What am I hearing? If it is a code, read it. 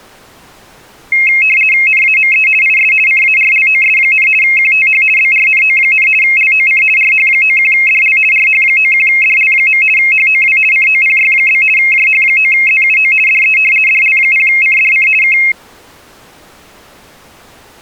RTTY (50 baud, 450 Hz shift), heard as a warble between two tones, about 2350 Hz centre. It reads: NAME IS CARLOS, QTH BRNO, LOC RH91DL RH91DL. HOW COPY? JH9ZUO DE DL0CDC K